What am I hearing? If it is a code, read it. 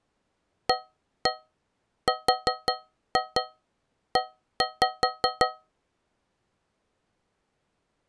Tap code, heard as taps on a metal pipe, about 5 knocks a second. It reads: ARE